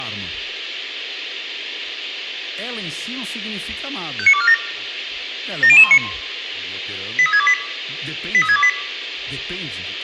Five-tone selective call (ZVEI), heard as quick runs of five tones, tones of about 70 ms, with radio hiss, room echo and speech in Portuguese. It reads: 59247 70019 83628 83628